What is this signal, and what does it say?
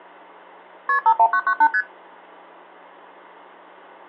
Multi-frequency trunk signalling (R1, as on North American trunks), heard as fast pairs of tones, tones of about 70 ms, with hum. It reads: KP 51998 ST